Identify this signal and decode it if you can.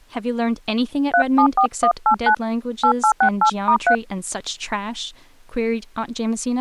DTMF, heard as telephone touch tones, dialled by hand, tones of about 80 ms, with speech in English. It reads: 374189 8868*3